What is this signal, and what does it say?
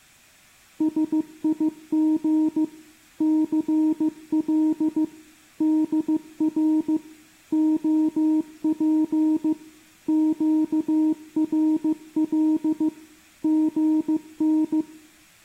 Morse code, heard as a keyed tone, machine-sent, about 15 wpm, 310 Hz, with room echo. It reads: SIG CL DR OP QRL GN